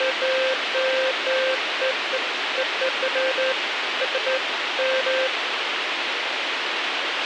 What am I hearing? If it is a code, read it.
Beeps of irregular length, with radio hiss and a squelch burst at the end. There is no code.